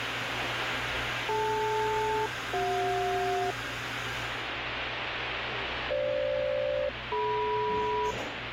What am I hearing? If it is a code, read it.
Aircraft SELCAL, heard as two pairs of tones, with radio static and the noise of a cafe. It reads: DL-CJ FG-DM